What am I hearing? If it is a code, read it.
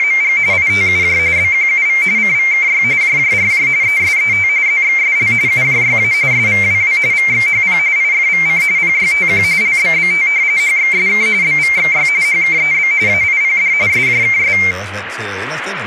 RTTY (45.45 baud, 170 Hz shift), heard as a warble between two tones, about 2200 Hz centre, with radio static and speech in Danish. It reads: … ITUJ BQUV CVKY JJRJ ESET ZXSL UJYA SVWW VXHP IFVC PYTQ LBBT HXSK BVXY HKEB AIPD SJKS